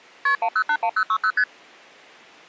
Multi-frequency trunk signalling (R1, as on North American trunks), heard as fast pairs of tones, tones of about 70 ms. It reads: KP 1081060 ST